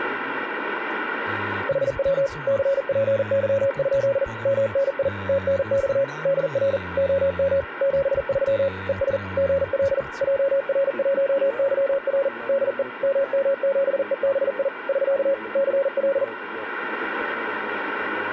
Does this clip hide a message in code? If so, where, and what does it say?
Yes: Morse code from 1.6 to 16.3 s, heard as a keyed tone, machine-sent, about 40 wpm, 550 Hz, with radio static. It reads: HW CPY? MNI TNX DR OM 73 ES GL JR1YR DE MM7EBI <SK> CL